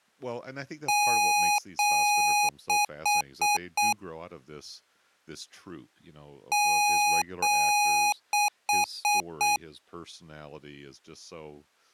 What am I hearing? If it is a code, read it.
Beep code, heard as beeps from a small speaker, played twice, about 830 Hz, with speech in English. 2 long, 4 short.